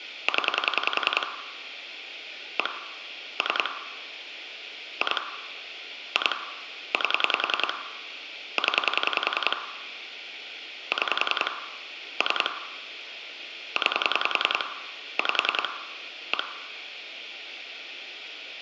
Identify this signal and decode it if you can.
Pulse dialling, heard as clicks on a phone line, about 10 pulses a second, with phone line noise and room echo. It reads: 0 1 3 2 2 8 0 6 3 9 5 1